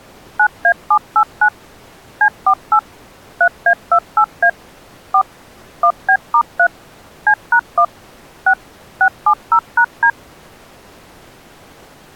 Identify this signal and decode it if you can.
DTMF, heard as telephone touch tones, dialled by machine, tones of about 70 ms. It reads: 9A789 C48 3A28A 4 1B*3 C#1 6 670#D